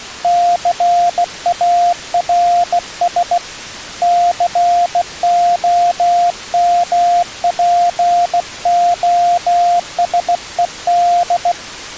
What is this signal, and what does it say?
Morse code, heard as a keyed tone, hand-sent with a bug key, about 16 wpm, 700 Hz. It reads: CARS COMPOSED